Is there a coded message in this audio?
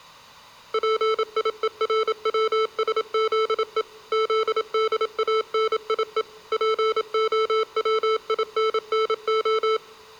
Yes: Morse code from 0.7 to 9.8 s, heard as electronic beeps, machine-sent, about 27 wpm, 440 Hz, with room echo. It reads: PIERWSZE ZDANIE POWINNO